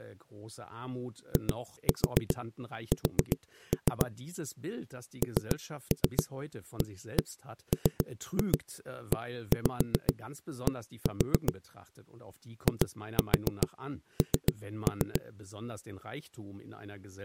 Tap code, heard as knocks on a wall, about 7 knocks a second, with speech in German. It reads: IS NAMED IN